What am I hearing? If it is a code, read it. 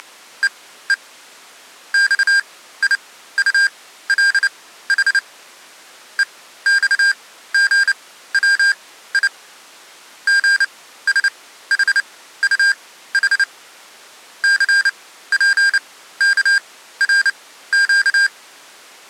Morse code, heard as electronic beeps, machine-sent, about 29 wpm, spaced as for 15 wpm, 1600 Hz. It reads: … XIULH EXGWI GSHUH CPKRQ